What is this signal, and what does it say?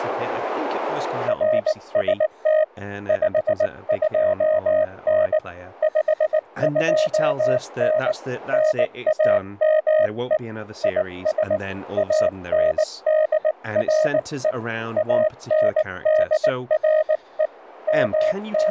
Morse code, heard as a keyed tone, hand-sent with a paddle, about 19 wpm, 620 Hz, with speech in English. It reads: RST 52N 52N NAME IS ANDRE ANDRE …